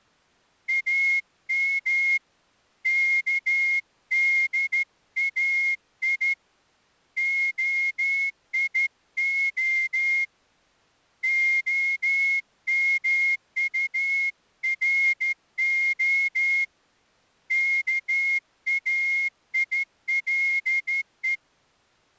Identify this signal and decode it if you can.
Morse code (Hebrew alphabet), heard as a whistle, hand-sent with a straight key, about 13 wpm. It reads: אם כדאי היה המטרה כאילו